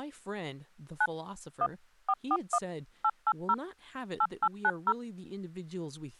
DTMF, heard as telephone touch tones, dialled by machine, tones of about 50 ms, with speech in English. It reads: 9 1 441 880 8890